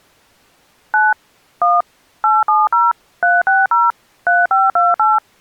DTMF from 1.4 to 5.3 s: 1 870 360 3528

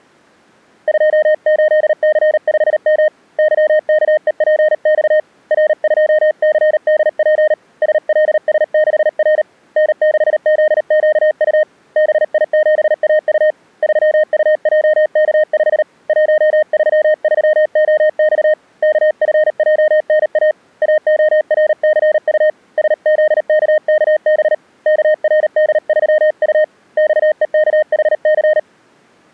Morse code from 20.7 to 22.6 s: AORCU

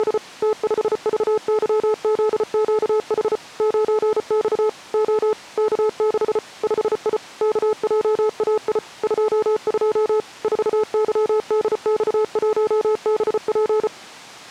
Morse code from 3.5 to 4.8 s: 9X

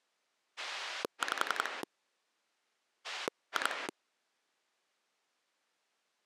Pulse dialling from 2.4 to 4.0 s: 2

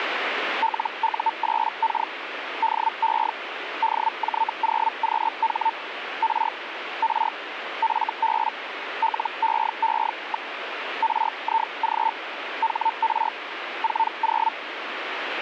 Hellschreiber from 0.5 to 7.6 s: LU8K DE DJ0QH R R

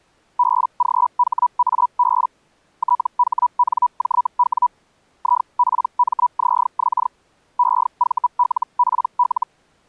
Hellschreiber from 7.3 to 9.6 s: EVLPL

